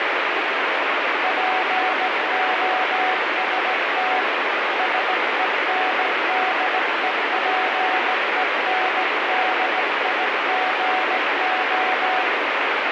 Morse code, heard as a keyed tone, hand-sent with a straight key, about 17 wpm, 750 Hz, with heavy radio static. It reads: POST SENDEPENDIGO